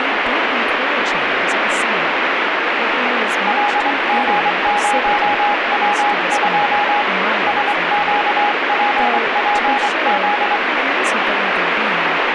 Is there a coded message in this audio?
Yes: Morse code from 3.4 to 10.6 s, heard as a keyed tone, hand-sent with a straight key, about 24 wpm, 830 Hz, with heavy radio static and speech in English. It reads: LG0W2 SQPPZ